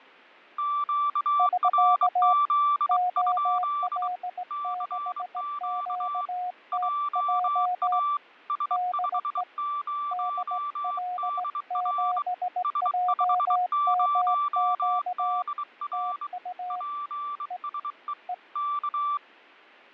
Morse code, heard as two keyed tones, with fading. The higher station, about 23 wpm, 1170 Hz: QRZ? CQ JA S50DR S50DR PSE K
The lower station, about 18 wpm, 720 Hz: <SK> OL6QTJ DE DL7JMQ TU E E